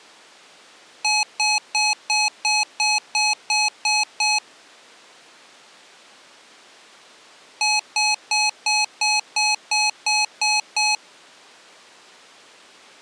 Beep code, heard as beeps from a small speaker, played twice, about 850 Hz. 10 short. In AMI BIOS tables: CMOS shutdown register error.